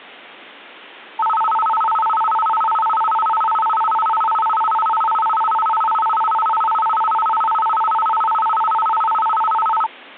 A tone that alternates evenly between two pitches. There is no code.